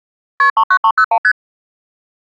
Multi-frequency trunk signalling (R1, as on North American trunks), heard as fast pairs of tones, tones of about 70 ms. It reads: KP 39301 ST